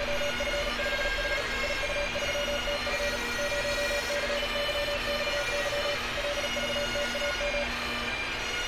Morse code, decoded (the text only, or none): … IU3TF 0CYXY LVTAM